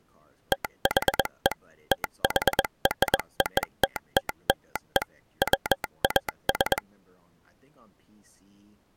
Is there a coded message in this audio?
Yes: Morse code (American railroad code) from 0.5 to 6.8 s, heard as a telegraph sounder, machine-sent, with speech in English. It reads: THE THROTTLE WAS